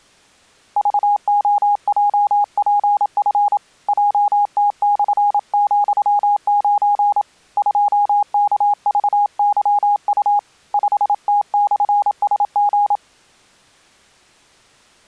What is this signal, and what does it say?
Morse code, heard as a keyed tone, hand-sent with a paddle, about 27 wpm, 820 Hz. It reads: VOJPF JT/,9 2KVYU 5T/SG